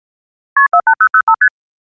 Multi-frequency trunk signalling (R1, as on North American trunks), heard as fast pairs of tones, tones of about 70 ms. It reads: KP 48005 ST